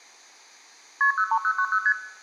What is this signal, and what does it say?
Multi-frequency trunk signalling (R1, as on North American trunks), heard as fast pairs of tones, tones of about 70 ms, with room echo. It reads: KP 03090 ST